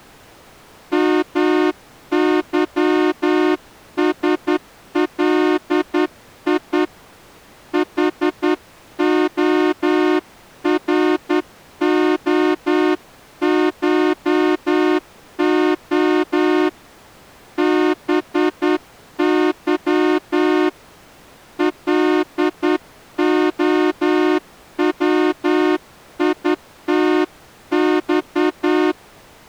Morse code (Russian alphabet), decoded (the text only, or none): МЫСЛИ ХОРОШО БЫ ЛОВИТЬ